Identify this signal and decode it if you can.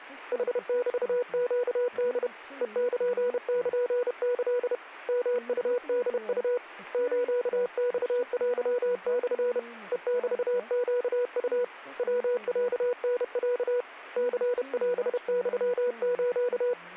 Morse code (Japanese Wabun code), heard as a keyed tone, hand-sent with a paddle, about 31 wpm, 490 Hz, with speech in English. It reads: ヌメネホ ヘルルキ ヨウホウ スマテモ ヘメネウ ヤロタロ ニオユス